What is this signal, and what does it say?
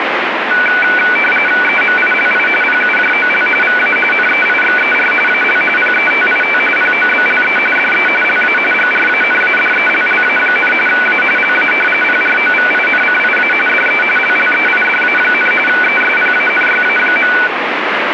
RTTY (45.45 baud, 850 Hz shift), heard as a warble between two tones, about 1900 Hz centre, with radio static. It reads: EMILI PUJOL VA NEIXER AL PETIT POBLE DE LA GRANADELLA, A LA PROVINCIA DE LLEIDA, ESPANYA.